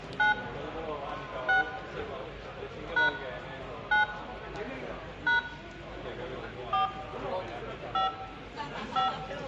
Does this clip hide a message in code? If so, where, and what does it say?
Yes: DTMF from 0.2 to 9.1 s, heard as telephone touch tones, dialled by hand, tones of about 130 ms, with room echo and the noise of a crowd indoors. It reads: 9 6 # 9 # 4 5 5